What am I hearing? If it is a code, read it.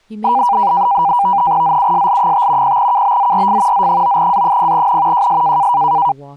NAVTEX (SITOR-B), 100 baud, 170 Hz shift, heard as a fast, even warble, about 880 Hz centre, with speech in English. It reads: ZUSL5 0KBZRF Z9A0N JS